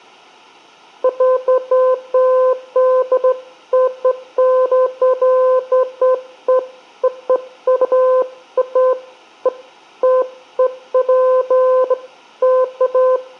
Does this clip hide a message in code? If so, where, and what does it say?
No, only beeps of irregular length, with room echo.